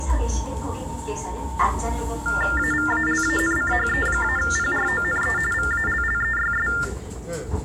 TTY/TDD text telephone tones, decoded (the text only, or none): AVALANCHE-PRONE VALLEYS